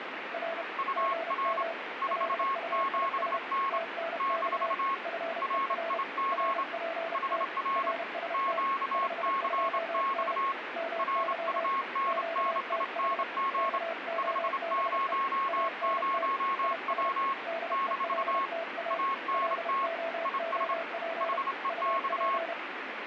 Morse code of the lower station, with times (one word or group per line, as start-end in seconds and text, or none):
0.3-0.6 R
1.0-1.7 GM
2.1-3.4 LUIS
3.7-4.7 TNX
5.1-6.0 FER
6.3-7.4 RPT
7.8-8.6 RST
8.9-10.3 52N
10.8-11.7 MY
12.1-13.2 QTH
13.6-15.1 KOBE
15.5-16.3 ANT
16.6-17.1 IS
17.5-19.0 DELTA
19.3-21.4 LOOP
21.7-22.5 UP